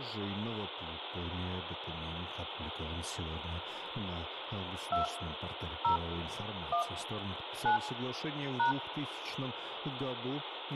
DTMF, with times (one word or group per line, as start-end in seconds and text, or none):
4.9-5.1 2
5.8-6.0 0
6.7-6.8 1
7.7-7.8 9
8.6-8.7 #